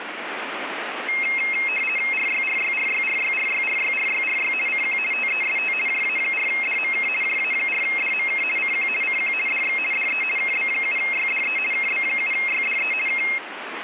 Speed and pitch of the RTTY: 50 baud, 450 Hz shift, 2350 Hz centre

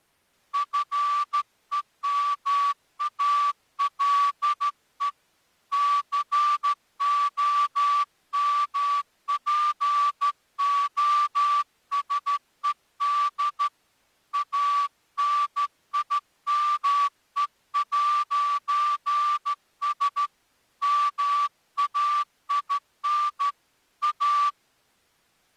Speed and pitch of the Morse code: 13 wpm

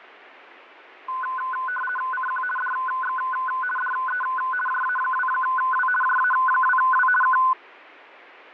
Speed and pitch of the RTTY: 50 baud, 450 Hz shift, 1260 Hz centre

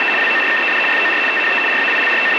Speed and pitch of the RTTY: 75 baud, 850 Hz shift, 2250 Hz centre

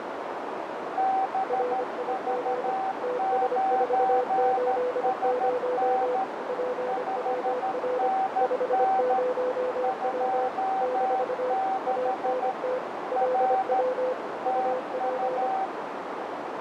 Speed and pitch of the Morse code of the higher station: 13 wpm, 770 Hz

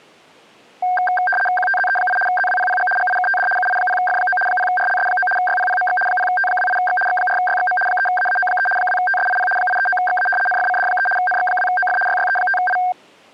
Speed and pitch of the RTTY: 75 baud, 850 Hz shift, 1160 Hz centre

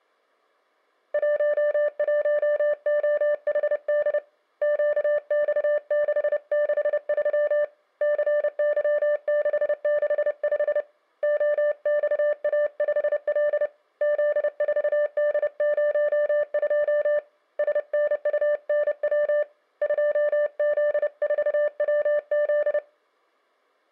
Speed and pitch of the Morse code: 30 wpm, 590 Hz

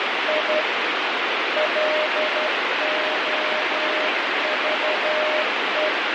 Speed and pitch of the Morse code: 12 wpm, 610 Hz

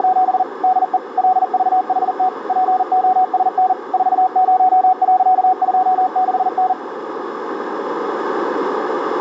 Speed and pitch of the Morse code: 40 wpm, 740 Hz

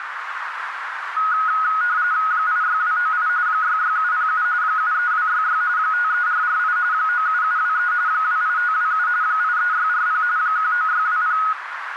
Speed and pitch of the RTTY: 45.45 baud, 170 Hz shift, 1360 Hz centre

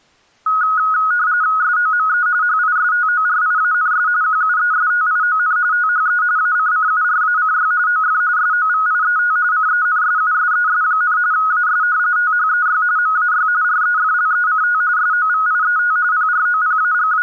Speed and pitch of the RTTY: 45.45 baud, 170 Hz shift, 1360 Hz centre

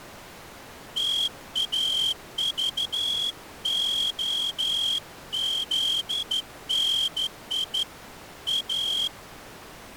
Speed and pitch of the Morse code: 13 wpm

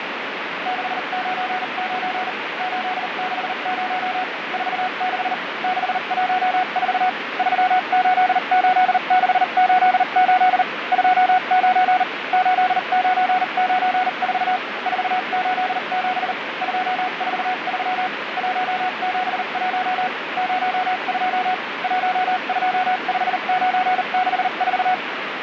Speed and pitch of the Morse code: 39 wpm, spaced as for 34 wpm, 740 Hz

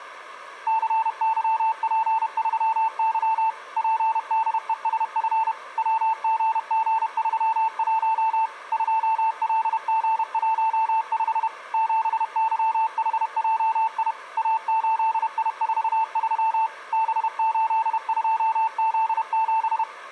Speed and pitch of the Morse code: 31 wpm, 890 Hz

